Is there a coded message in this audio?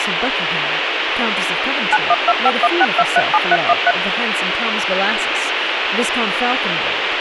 Yes: DTMF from 1.9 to 3.9 s, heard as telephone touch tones, dialled by machine, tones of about 40 ms, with radio hiss and speech in English. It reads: 912516237313